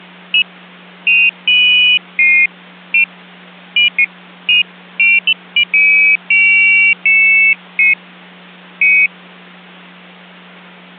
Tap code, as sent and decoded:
none

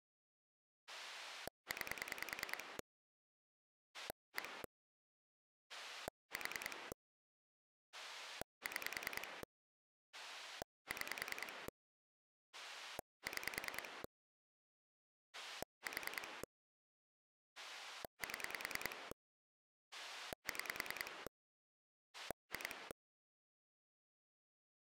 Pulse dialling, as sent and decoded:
9 / 1 / 4 / 6 / 6 / 6 / 4 / 7 / 6 / 2
9 1 4 6 6 6 4 7 6 2

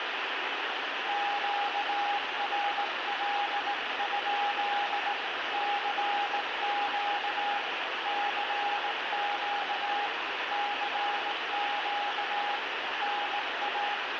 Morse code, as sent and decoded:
--.- .-. .-.. ..--.. / -.-. --.- / -.-. --.- / -.-. --.- / -. .-
QRL? CQ CQ CQ NA

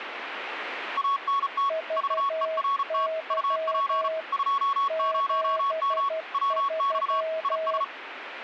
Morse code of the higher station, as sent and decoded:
.- -. - / ...- . .-. - / ..- .--. / ..--- ----- -- / .-- -..- / .. ...
ANT VERT UP 20M WX IS

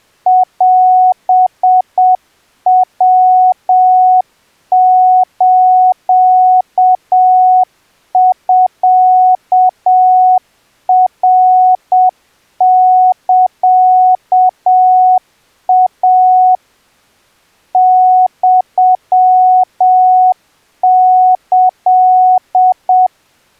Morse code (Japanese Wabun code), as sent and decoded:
.-... .-- ---.- ..-.- .-. -.-.- .- / -..-- -.-..
オヤスミナサイ ユキ

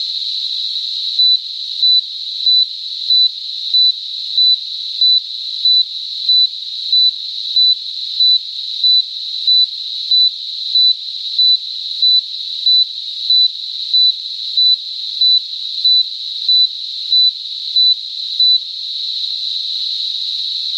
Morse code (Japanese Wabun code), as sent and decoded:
none

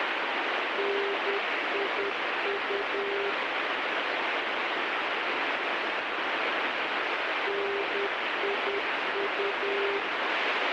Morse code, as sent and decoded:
-. .. ..- / -. .. ..-
NIU NIU

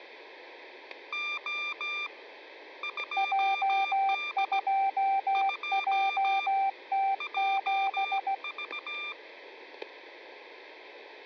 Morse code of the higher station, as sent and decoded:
--- / ..--- -.. / ..--- / .--- ...-
O 2D 2 JV

